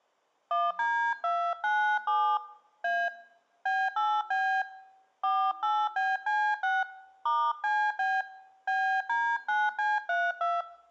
DTMF, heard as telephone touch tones, dialled by hand, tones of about 270 ms. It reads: 1D297 A B8B 48BC6 *CB BD9C32